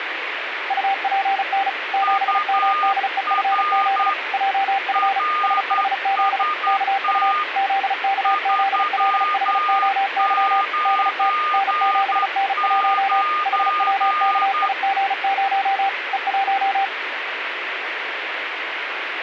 Morse code, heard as two keyed tones, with radio static. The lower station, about 35 wpm, 780 Hz: UPN 7MDEFZ JF SHZ KU ZKZLHOY DT N7N1 HWKIG0 E1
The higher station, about 10 wpm, 1220 Hz: UR RST 399